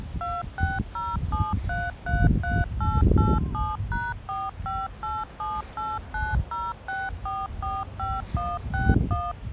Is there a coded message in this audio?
Yes: DTMF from 0.2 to 9.3 s, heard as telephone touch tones, dialled by machine, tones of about 210 ms, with hum and the noise of a residential street. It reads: 2607333887#45878906445161